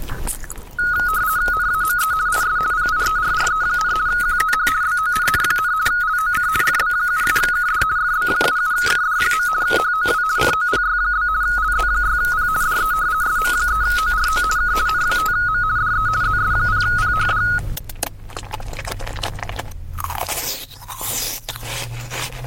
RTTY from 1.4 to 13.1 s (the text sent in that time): NAME IS PIERRE, QTH BONN, LOC FB77KD FB77KD. HOW COPY? LZ6P DE